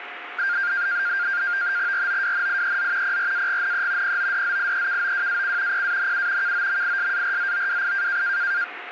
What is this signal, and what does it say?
NAVTEX (SITOR-B), 100 baud, 170 Hz shift, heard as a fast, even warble, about 1500 Hz centre, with radio static and a steady whistle near 720 Hz. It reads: ROWNIEZ PRAGNE PODZIEKOWAC PANU KOMISARZOWI